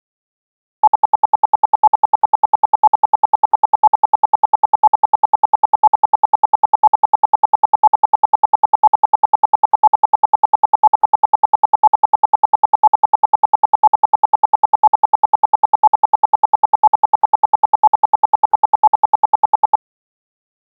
Radio time signal (RWM, Moscow), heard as ten pulses a second.